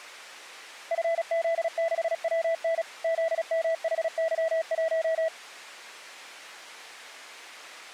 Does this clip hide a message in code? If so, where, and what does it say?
Yes: Morse code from 0.9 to 5.3 s, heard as a keyed tone, machine-sent, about 36 wpm, 660 Hz. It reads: FZ6WN ZMHY1